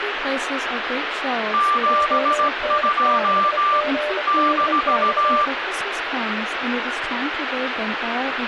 Morse code, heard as two keyed tones, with radio static and speech in English. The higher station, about 16 wpm, 1180 Hz: 72 -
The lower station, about 29 wpm, 600 Hz: ON6GDX